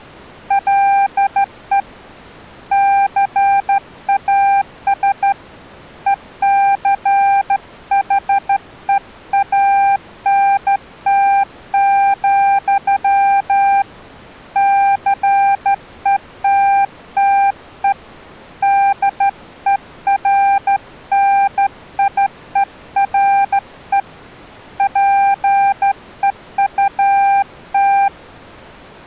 Morse code, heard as a keyed tone, hand-sent with a straight key, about 13 wpm, 790 Hz. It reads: LE CAS ECHEANT, CETTE DERNIERE PEUT